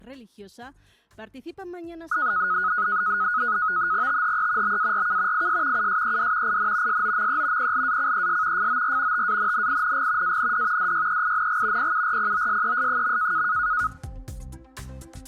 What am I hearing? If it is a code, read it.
NAVTEX (SITOR-B), 100 baud, 170 Hz shift, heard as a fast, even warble, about 1360 Hz centre. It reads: THE BARK IS USED IN SOME PLACES FOR TANNING AND DYEING PURPOSES.